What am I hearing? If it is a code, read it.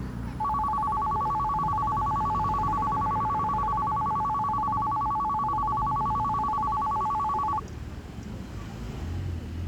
A tone that alternates evenly between two pitches, with street noise. There is no code.